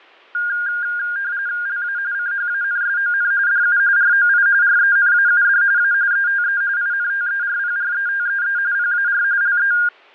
RTTY (45.45 baud, 170 Hz shift), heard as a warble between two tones, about 1500 Hz centre, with fading. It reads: LA CHANSON DU ROI RENAUD A ETE INTERPRETEE PAR LE